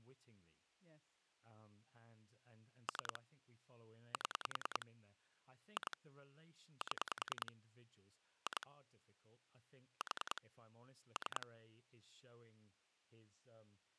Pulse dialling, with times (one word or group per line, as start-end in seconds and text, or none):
2.9-3.2 3
4.1-4.9 7
5.8-6.0 2
6.8-7.5 7
8.5-8.7 2
10.0-10.4 4
11.2-11.5 3